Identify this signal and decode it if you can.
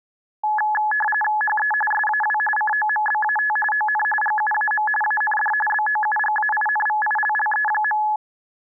RTTY (45.45 baud, 850 Hz shift), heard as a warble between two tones, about 1280 Hz centre. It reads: HE SAW COMBAT ON GUAM AND BOUGAINVILLE.